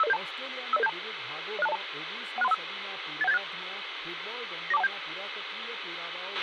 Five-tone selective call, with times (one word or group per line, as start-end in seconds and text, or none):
0.0-0.2 50072
0.7-0.9 50072
1.6-1.8 06202
2.4-2.5 16315
3.2-3.4 81786
4.7-4.9 94217